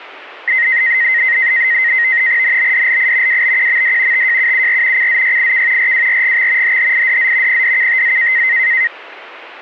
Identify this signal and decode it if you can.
NAVTEX (SITOR-B), 100 baud, 170 Hz shift, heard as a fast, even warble, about 1950 Hz centre. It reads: NBDLI WBQMD TJUUR CZYIK RWRGX HHIDZ PDKTZ